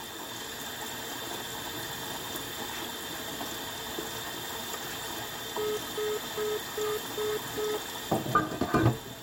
Telephone call progress tone (single-tone plan, as in most of Europe), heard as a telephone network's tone, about 420 Hz, 0.2 s on and 0.2 s off, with kitchen noise. Congestion tone.